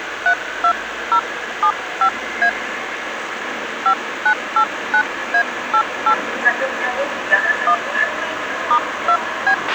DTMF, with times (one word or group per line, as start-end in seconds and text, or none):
0.3-2.5 32075A
3.9-6.1 5989A88
7.7-7.7 1
8.7-9.5 *2B